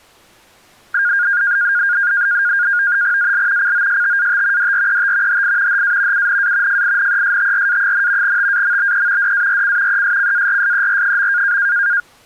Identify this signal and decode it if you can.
NAVTEX (SITOR-B), 100 baud, 170 Hz shift, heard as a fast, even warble, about 1500 Hz centre. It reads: AL COSTAT DRET HI HA UNA FINESTRA, TAMBE DARC ESCARSER.